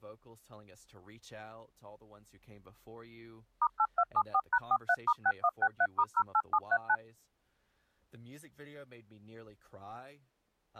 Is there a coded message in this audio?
Yes: DTMF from 3.6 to 7.0 s, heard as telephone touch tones, dialled by machine, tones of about 60 ms, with speech in English. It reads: *8274#43*6163*08739